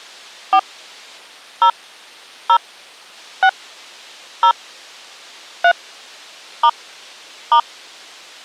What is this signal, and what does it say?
DTMF, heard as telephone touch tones, dialled by hand, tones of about 80 ms. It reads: 4 0 0 6 0 3 * *